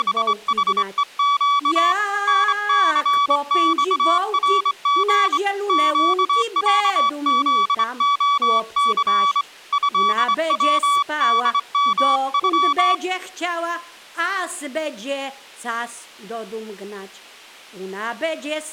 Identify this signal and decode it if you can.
Morse code (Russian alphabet), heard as a keyed tone, hand-sent with a straight key, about 24 wpm, 1140 Hz. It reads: … НЦЬРГ ЩЯЗОЦ ЭВДМЮ